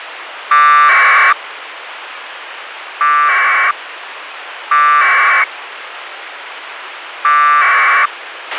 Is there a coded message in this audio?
Yes: packet radio (AX.25, as in APRS), 1200 baud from 0.5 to 8.1 s, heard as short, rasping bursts, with radio hiss and a squelch burst at the end.